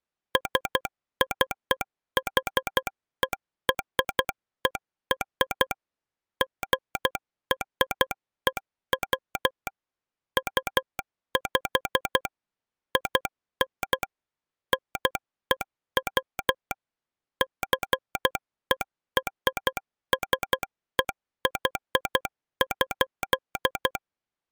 Morse code (American railroad code), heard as a telegraph sounder, machine-sent. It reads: SCHERER GREW UP IN NEW JERSEY.